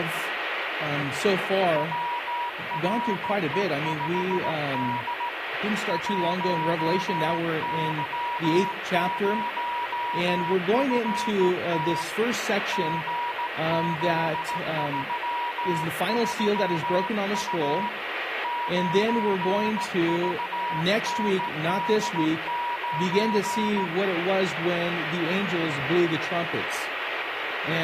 Morse code, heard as a keyed tone, hand-sent with a straight key, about 16 wpm, 960 Hz, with radio static. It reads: WRE5D 1Y0FT GZ33U 9VND9